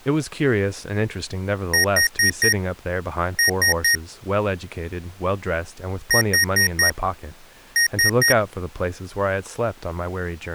Beep code, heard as beeps from a small speaker, played twice, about 1850 Hz, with speech in English. 4-3.